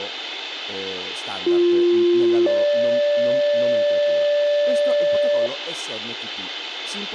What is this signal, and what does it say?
Two-tone page, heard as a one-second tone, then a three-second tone, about 350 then 580 Hz, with radio hiss, room echo and speech in Italian.